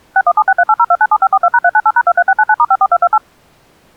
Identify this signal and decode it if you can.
DTMF, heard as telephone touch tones, dialled by machine, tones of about 50 ms. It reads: 6176380297542#398#23699*54228